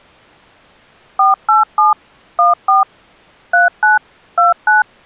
DTMF, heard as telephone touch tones, dialled by machine, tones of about 150 ms. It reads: 487 14 39 29